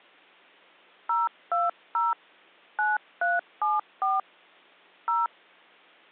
DTMF, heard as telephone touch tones, dialled by hand, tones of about 180 ms. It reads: 020 9374 0